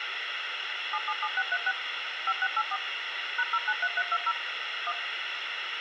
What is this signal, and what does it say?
DTMF, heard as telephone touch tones, dialled by machine, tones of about 50 ms, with radio hiss and a squelch burst at the end. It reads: 777636 5684 #093320 1